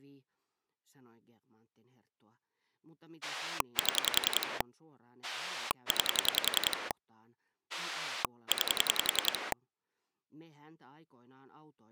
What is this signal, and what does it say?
Pulse dialling, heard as a rotary dial, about 10 pulses a second, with speech in Finnish. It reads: 7 9 9